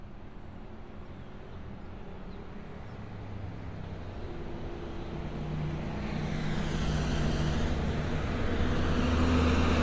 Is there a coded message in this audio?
No, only street noise.